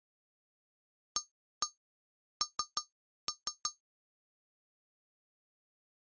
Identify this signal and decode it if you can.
Tap code, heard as taps on glass, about 6 knocks a second. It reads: AN